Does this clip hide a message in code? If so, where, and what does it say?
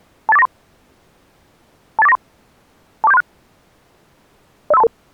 Yes: five-tone selective call (EIA) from 0.3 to 4.9 s, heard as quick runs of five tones, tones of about 30 ms. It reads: 28493 28493 24736 05322